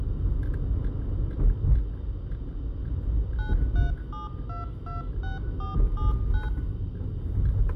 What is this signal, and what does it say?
DTMF, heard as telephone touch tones, dialled by machine, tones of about 150 ms, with room echo and the noise inside a car. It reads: 937226479